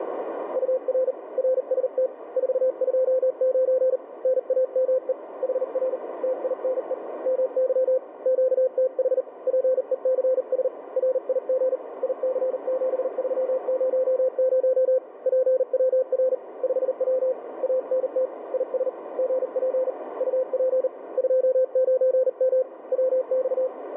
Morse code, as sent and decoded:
..- .-. / .-. ... - / ....- ..--- ----. / -. .- -- . / .... .-. / - .. -. . / -- -.-- / --.- - .... / .--. . -.-. ... / .-. .. --. / .. -.-. --... ...-- ----- ----- / .--. .-- .-. / ..... .-- / .- -. - / .. ... / --. .--. / ..- .--. / ..--- ----. -- / .-- -..-
UR RST 429 NAME HR TINE MY QTH PECS RIG IC7300 PWR 5W ANT IS GP UP 29M WX

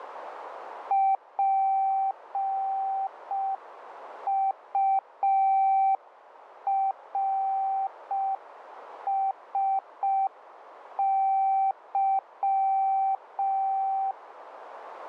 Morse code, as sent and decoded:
.--. ..- .-. ... -.--
PURSY

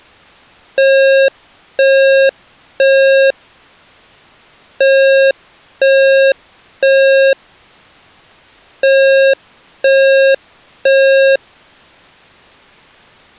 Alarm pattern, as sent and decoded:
3 beeps and a pause
temporal three

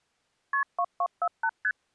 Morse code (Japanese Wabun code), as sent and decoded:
none

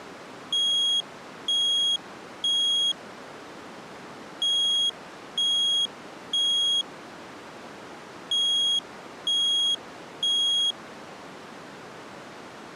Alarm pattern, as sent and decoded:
3 beeps and a pause
temporal three

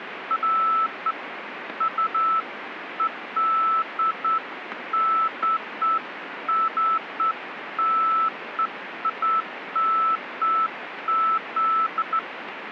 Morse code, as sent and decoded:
none

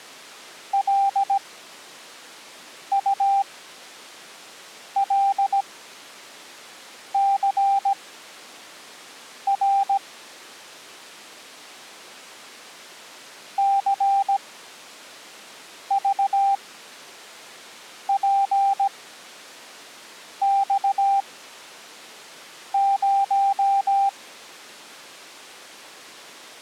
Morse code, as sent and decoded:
.-.. ..- .-.. -.-. .-. / -.-. ...- .--. -..- -----
LULCR CVPX0

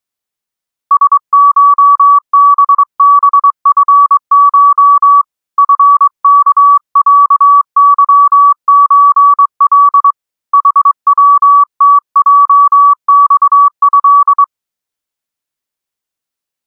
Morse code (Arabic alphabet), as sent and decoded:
... ---- -... -... ..-. ---- / ..-. -.- .-.- -.-- ---. .-.. / .... .-- - .--- -..- ..-..
سشببفش فكعظزل حوتجصه

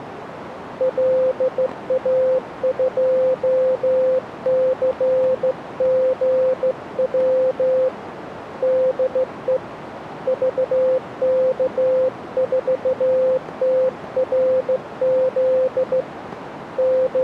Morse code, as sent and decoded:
.-.. .- ..--- -.-. --. .-- / -.. . / ...- -.- ....- - .-. --.. / …
LA2CGW DE VK4TRZ …

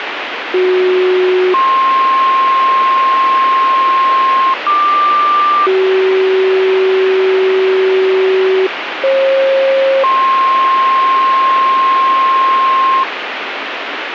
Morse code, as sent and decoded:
none

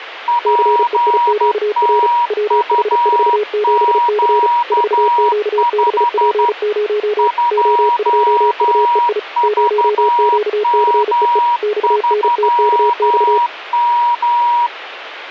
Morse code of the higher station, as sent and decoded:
.--. - ..- --.- ..... / ..--- ...- -- ...-- --
PTUQ5 2VM3M

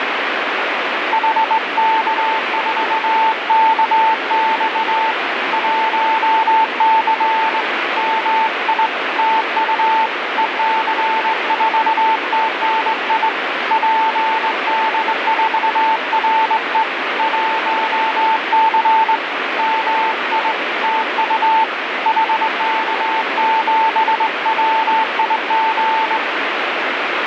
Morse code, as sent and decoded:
.... -.- ....- -.- -..- / .---- -.-. / -- .. / - ..- / . -.-. ....- - -. .. / .--. -.. ....- .-. . / .---- -.-. / -- .. / - ..- / .... -.- --... .-- .. --.
HK4KX 1C MI TU EC4TNI PD4RE 1C MI TU HK7WIG

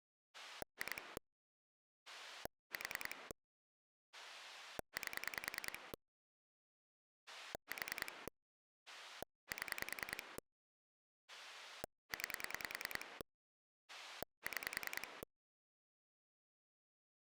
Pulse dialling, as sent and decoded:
2 / 4 / 8 / 4 / 7 / 9 / 6
2 4 8 4 7 9 6

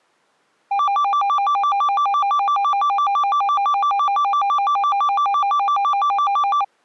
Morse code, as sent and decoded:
none

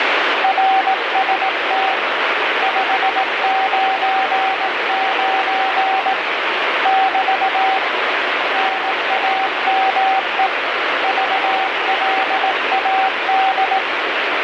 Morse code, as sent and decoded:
.-. ... - / ..... ----. ----. / -...- / -. .- -- . / ...- .-.. .- -..
RST 599 <BT> NAME VLAD

